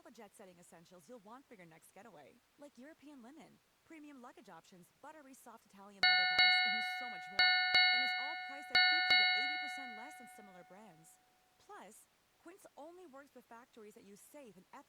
Ship's bell, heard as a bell, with speech in English. 6. Six half-hours of the watch have passed.